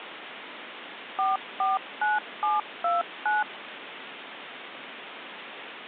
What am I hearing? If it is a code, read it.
DTMF, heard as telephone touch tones, dialled by machine, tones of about 170 ms, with phone line noise. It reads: 449729